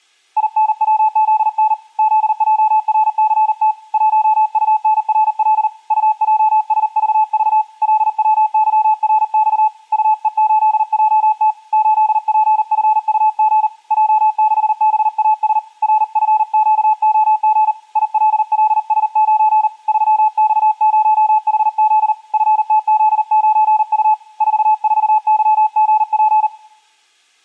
Morse code, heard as a keyed tone, hand-sent with a paddle, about 39 wpm, 860 Hz, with room echo. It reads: INWZN ZJRCT 1UNRL UJSVV LWYRX UE8JT 8PFUG J6BAS RFQOG ILLS9 3X0HZ FTZ9U 44YGP